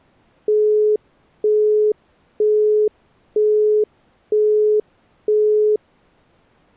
Telephone call progress tone (single-tone plan, as in Europe, Japan and elsewhere), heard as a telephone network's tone, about 420 Hz, 0.48 s on and 0.48 s off. Busy tone.